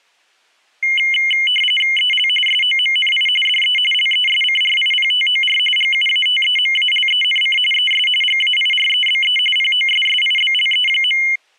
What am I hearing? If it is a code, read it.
RTTY (45.45 baud, 850 Hz shift), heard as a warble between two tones, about 2550 Hz centre. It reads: EL SOMNI DE LESCRIPTOR GUATEMALENC ES GAIREBE POSSIBLE.